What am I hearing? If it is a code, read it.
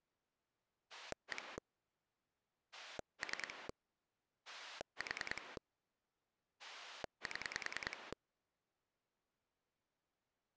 Pulse dialling, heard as a rotary dial, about 10 pulses a second. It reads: 1 3 4 7